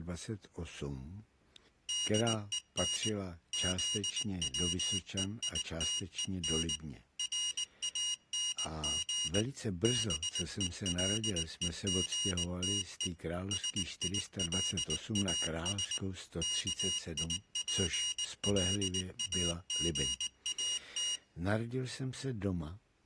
Morse code, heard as a high beeper, machine-sent, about 19 wpm, 2850 Hz. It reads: DEN ZWEITEN RANG BELEGTE SILAS KIPLAGAT